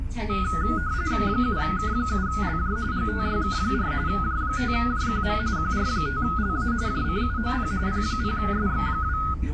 RTTY (45.45 baud, 170 Hz shift), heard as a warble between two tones, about 1360 Hz centre, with the noise inside a bus. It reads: 7K7LJ GTYK4 J5JQM QR5LA JCUOP P0SX2